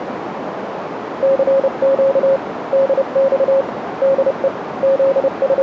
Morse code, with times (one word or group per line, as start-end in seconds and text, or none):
1.2-2.4 CQ
2.7-3.6 DX
4.0-4.5 DE
4.8-5.6 …